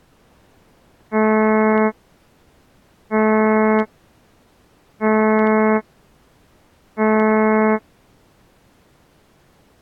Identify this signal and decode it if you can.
Ship horn signal, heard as a ship's horn, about 220 Hz. 4 short. At sea: a pilot vessel's identity signal in fog.